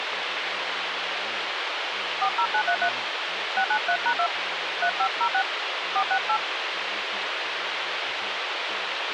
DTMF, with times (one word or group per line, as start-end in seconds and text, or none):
2.2-2.9 40933
3.6-4.3 693#2
4.8-5.4 3506
6.0-6.4 468